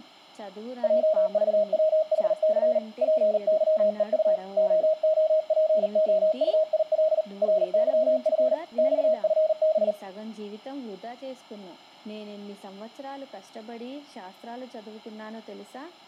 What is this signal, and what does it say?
Morse code, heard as a keyed tone, hand-sent with a paddle, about 39 wpm, 630 Hz, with room echo. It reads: JVWHC PYEU OOPOUIL RYF XFB